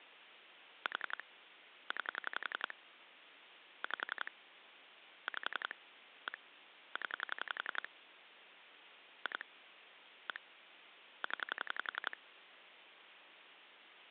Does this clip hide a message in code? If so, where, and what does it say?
Yes: pulse dialling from 0.9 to 12.1 s, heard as clicks on a phone line, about 11 pulses a second, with phone line noise. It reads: 4 9 5 5 1 0 2 1 0